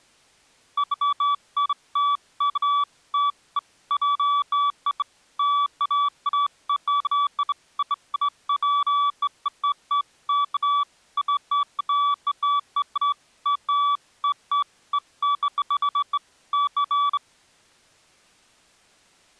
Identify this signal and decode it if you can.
Beeps of irregular length. There is no code.